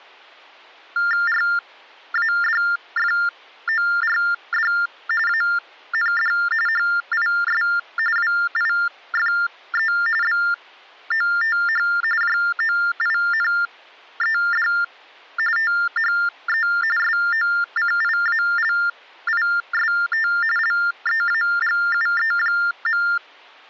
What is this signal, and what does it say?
TTY/TDD text telephone tones (45.45 baud Baudot), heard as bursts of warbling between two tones, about 400 Hz shift, 1600 Hz centre. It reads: RADFORD AND HIS WIFE BOTH JOINED THE SOCIALIST LEAGUE.